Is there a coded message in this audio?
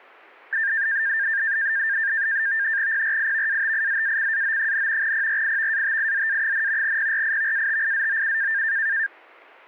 Yes: NAVTEX (SITOR-B), 100 baud, 170 Hz shift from 0.5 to 9.1 s, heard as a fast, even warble, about 1700 Hz centre. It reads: PRIVATIZACAO, PRIVATIZA, PRIVATIZOU